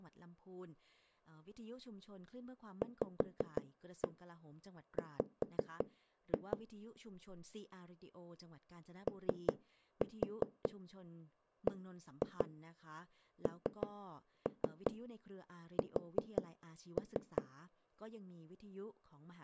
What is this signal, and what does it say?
Tap code, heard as knocks on a wall, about 5 knocks a second, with speech in Thai. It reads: VW OBNS